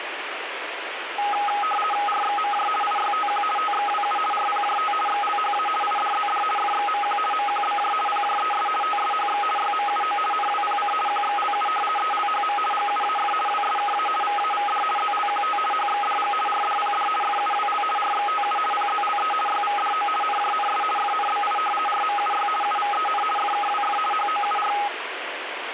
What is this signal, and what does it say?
RTTY (50 baud, 450 Hz shift), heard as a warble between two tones, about 1040 Hz centre, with radio static. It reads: RXMJ IYTQ TXWU RPJT XLHA IDZD FXMQ MQBJ PJES TSHX YMUO NWPC QXLU ELHM GUAF WSKA VAVD ZLQT HXDG RDPD FUWL RXTU PZLE YVDO NJNS FNBI RMUY UVEN FKWF HOUR